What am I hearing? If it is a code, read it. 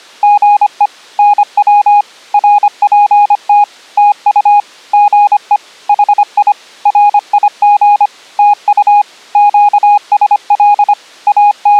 Morse code, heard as a keyed tone, machine-sent, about 25 wpm, 820 Hz. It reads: GE NW RPT TU GE HI RIG TU QSL …